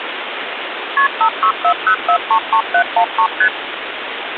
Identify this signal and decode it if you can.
Multi-frequency trunk signalling (R1, as on North American trunks), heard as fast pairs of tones, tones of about 80 ms, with phone line noise. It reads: KP 5640433713 ST